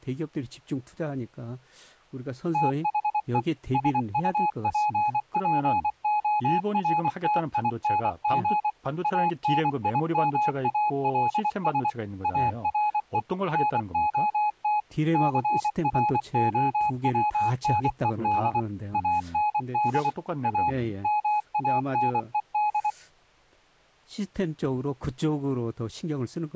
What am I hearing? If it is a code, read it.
Morse code, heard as a keyed tone, machine-sent, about 24 wpm, 840 Hz, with speech in Korean. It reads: THE SUPPORTING ANIMALS ARE NOT CROWNED AND A MANED